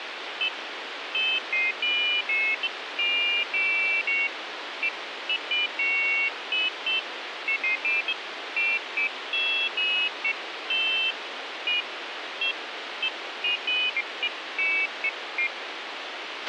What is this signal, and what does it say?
Pairs of high tones at irregular times, with radio hiss and a squelch burst at the end. There is no code.